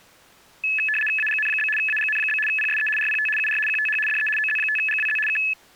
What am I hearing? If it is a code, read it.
RTTY (75 baud, 850 Hz shift), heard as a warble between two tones, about 2150 Hz centre. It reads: AGN? AGN? PSE RPT UR QTH DE OZ5GWZ K